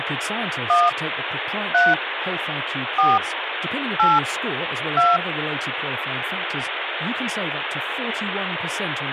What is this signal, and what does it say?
DTMF, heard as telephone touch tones, dialled by hand, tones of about 200 ms, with phone line noise and speech in English. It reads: 1 3 4 8 2